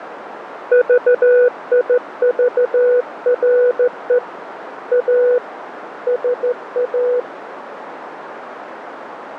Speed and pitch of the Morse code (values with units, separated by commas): 14 wpm, 490 Hz